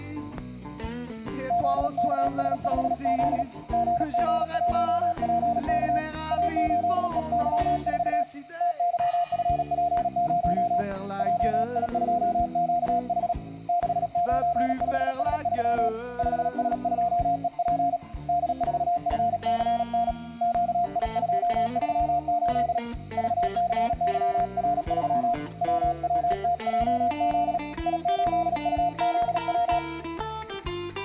Morse code, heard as a keyed tone, hand-sent with a paddle, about 37 wpm, 700 Hz, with room echo. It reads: ZKS5Z GG1PK A8EY4 TYFP0 JI2QH 695S3 5S2EP D4FCN QI238 VCYR3 WWTJZ I8UZW